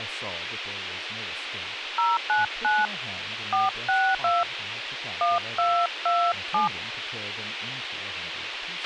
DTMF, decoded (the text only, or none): 099 462 1227